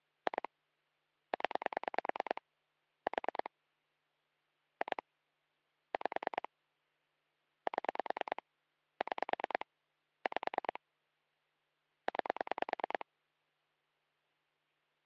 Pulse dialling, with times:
0.3-0.5 2
1.3-2.4 0
3.1-3.5 4
4.8-5.0 2
5.9-6.5 5
7.7-8.4 7
9.0-9.7 6
10.3-10.8 5
12.1-13.1 9

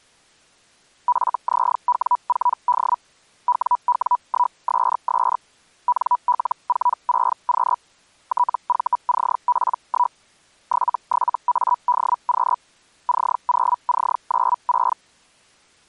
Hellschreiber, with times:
1.1-3.0 FZW4D
3.5-5.4 WW1SS
5.9-7.8 NL46Q
8.3-10.2 TVCP1
10.7-12.6 77ADQ
13.1-15.0 C0C96

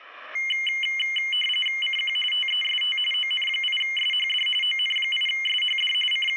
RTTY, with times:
1.8-2.2 CQ
2.3-3.0 TEST
3.1-4.5 ON8SHD
4.6-5.9 ON8SHD
6.1-6.4 …

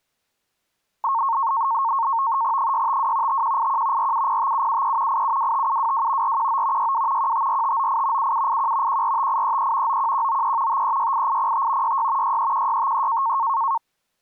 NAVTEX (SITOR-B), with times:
2.6-3.4 652
3.3-4.1 5181
4.0-5.2 4705773
5.1-6.4 8725722
6.2-6.9 419
6.8-7.3 62
7.2-8.3 154598
8.2-9.0 7781
8.9-10.0 145833
9.9-10.8 91193
10.7-12.0 5368805
11.8-12.4 66
12.2-13.4 631653

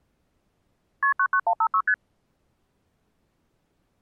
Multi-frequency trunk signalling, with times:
1.0-1.1 KP
1.2-1.8 99156
1.9-1.9 ST

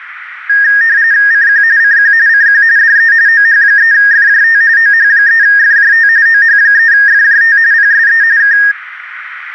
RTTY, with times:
1.3-1.6 CQ
1.8-2.1 CQ
2.3-2.6 CQ
2.8-3.1 DE
3.3-4.6 OH3FJT
4.8-6.1 OH3FJT
6.3-7.6 OH3FJT
7.7-8.2 PSE
8.4-8.6 K

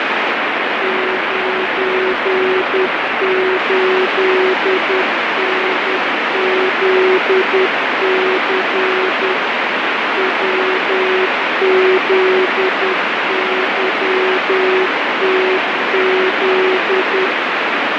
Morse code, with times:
0.8-9.3 98NZC
10.2-17.3 WZYTZ

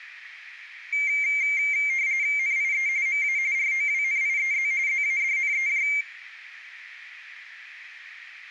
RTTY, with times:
2.4-2.9 NIE
3.1-3.4 MA
3.5-4.7 ROWNIEZ
4.9-5.9 ZADNEJ

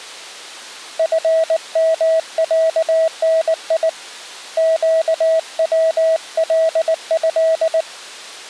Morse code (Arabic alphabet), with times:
1.0-3.9 فمعني
4.6-7.8 قوله

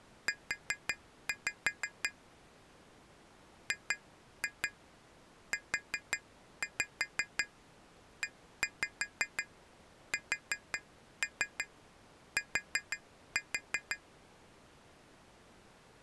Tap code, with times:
0.3-2.1 U
3.7-14.0 GUEST

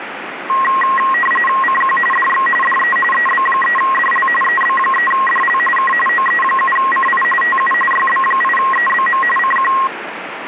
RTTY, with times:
1.6-2.0 CQ
2.1-2.5 DX
2.6-3.0 DE
3.1-4.3 EB3DL
4.4-5.6 EB3DL
5.8-5.9 K
6.1-7.2 OE7CI
7.4-7.7 TU
7.9-9.2 YB8EBM
9.4-9.7 CQ

